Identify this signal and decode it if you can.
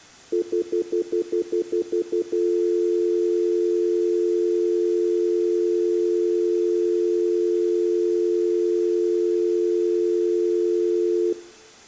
Telephone call progress tone (North American plan), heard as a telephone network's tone, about 350, 440 Hz, 0.1 s on and 0.1 s off, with room echo. Stutter dial tone.